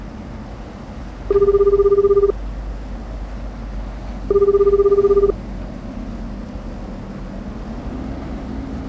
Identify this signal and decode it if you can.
Telephone call progress tone (Japanese plan), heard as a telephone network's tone, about 380, 400, 420 Hz, 1 s on and 2 s off, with street noise. Ringback tone.